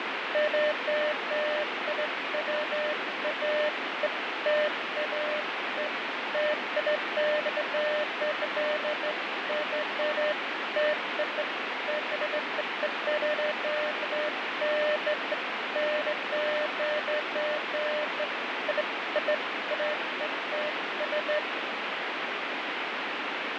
Beeps of irregular length, with heavy radio static and fading. There is no code.